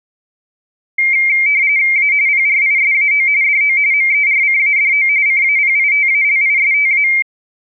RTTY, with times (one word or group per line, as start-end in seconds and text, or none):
2.0-2.1 A
2.3-3.3 PRISAO
3.4-3.8 DO
3.9-5.1 MERCADO
5.3-7.1 CAPITALISTA